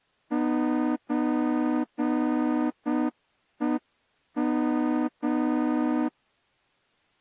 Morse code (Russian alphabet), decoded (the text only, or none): ЧЕМ